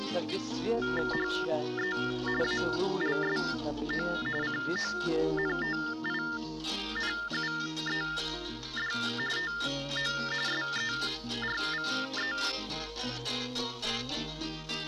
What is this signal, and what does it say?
TTY/TDD text telephone tones (45.45 baud Baudot), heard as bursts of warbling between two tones, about 400 Hz shift, 1600 Hz centre. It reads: HE ALSO CONTINUED TO SERVE